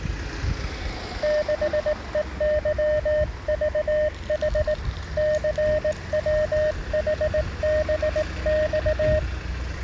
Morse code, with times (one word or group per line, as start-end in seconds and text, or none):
1.2-4.7 6EYVH
5.2-9.2 CWHBX